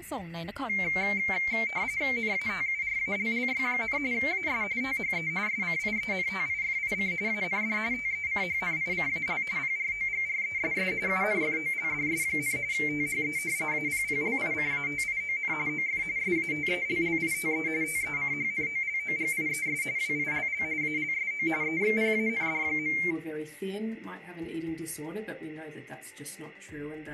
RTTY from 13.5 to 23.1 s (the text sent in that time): APPLICATION OF SATELLITE TECHNOLOGIES WILL ALSO EXPAND.